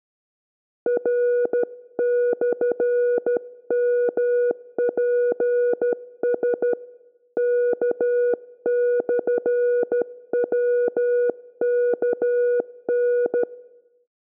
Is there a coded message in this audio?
Yes: Morse code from 0.8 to 13.5 s, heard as a keyed tone, hand-sent with a straight key, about 13 wpm, 490 Hz, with room echo. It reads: R/MPS K/WKN